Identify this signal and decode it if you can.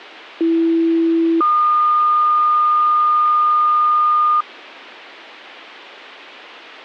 Two-tone page, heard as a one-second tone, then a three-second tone, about 330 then 1220 Hz.